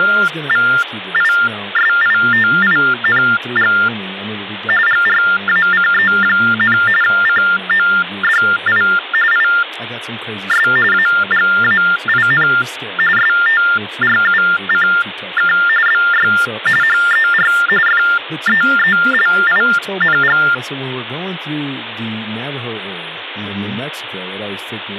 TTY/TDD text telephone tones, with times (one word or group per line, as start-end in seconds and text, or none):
0.0-3.7 …
4.9-6.8 GRACE,
7.0-8.8 CODI
9.3-10.7 IS
10.9-12.5 AGAIN
13.2-15.5 STRUCK
15.9-16.3 BY
16.8-17.5 HER
17.9-20.4 FEELING